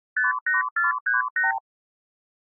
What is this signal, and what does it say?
Multi-frequency trunk signalling (R2, with the far end's replies), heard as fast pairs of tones, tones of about 150 ms. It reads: 58438